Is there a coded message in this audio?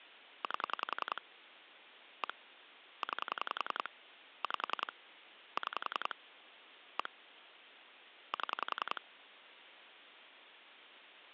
Yes: pulse dialling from 0.4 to 9.0 s, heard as clicks on a phone line, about 10 pulses a second, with phone line noise. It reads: 8 1 9 5 6 1 7